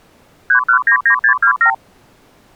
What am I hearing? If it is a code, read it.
Multi-frequency trunk signalling (R2, with the far end's replies), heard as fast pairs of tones, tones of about 90 ms. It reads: 3199627